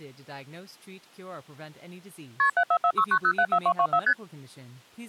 Multi-frequency trunk signalling (R1, as on North American trunks), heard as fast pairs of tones, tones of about 70 ms, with speech in English. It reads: KP 74469074224 ST